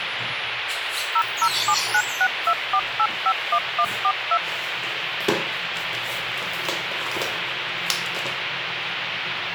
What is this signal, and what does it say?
DTMF, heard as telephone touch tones, dialled by machine, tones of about 60 ms, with phone line noise and the noise inside a lift. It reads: 0079624851142